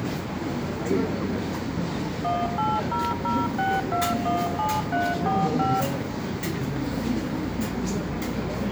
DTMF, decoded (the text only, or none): 18006217345